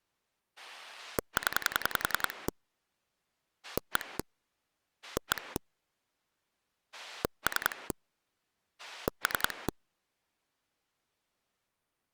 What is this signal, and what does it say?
Pulse dialling, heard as a rotary dial, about 10 pulses a second. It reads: 0 1 1 3 3